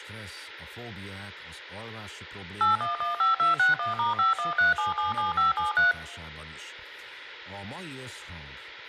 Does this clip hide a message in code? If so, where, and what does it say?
Yes: DTMF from 2.6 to 5.9 s, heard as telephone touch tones, dialled by machine, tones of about 140 ms. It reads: 8115261*513777573